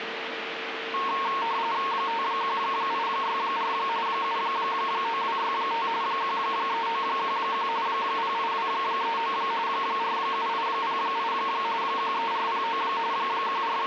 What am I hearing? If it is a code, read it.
RTTY (45.45 baud, 170 Hz shift), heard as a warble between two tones, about 1000 Hz centre, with radio static and a steady whistle near 450 Hz. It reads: 51864 79265 13911 08239 47808 13409 …